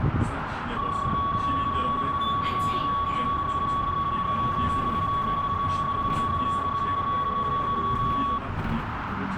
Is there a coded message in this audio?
Yes: PSK31 (31.25 baud) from 0.8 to 8.4 s, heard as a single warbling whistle, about 1120 Hz, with radio static, a narrow filter and the noise inside a bus.